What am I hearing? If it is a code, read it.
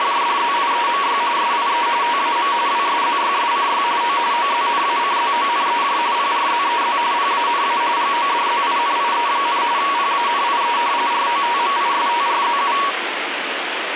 RTTY (45.45 baud, 170 Hz shift), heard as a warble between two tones, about 1040 Hz centre, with radio static. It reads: … SIE TAM WSZYSCY O OZNACZONEJ PRZEZ PANA GODZINIE, PANIE ROTMISTRZU